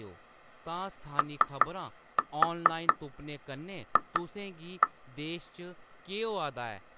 Tap code, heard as taps on glass, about 4 knocks a second, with speech in Dogri. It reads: OF